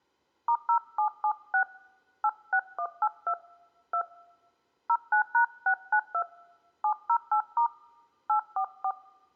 DTMF, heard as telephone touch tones, dialled by hand, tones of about 80 ms. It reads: *0776 86182 2 09#692 708* 844